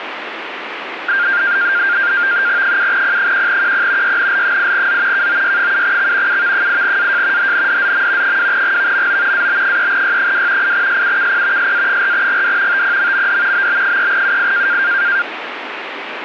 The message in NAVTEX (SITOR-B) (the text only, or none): 7P1QP YNL8Z KOY7X UV8AJ HNDZM 2GVMO AB3Y2 8SUKP SA4GD TPMMD BB3UI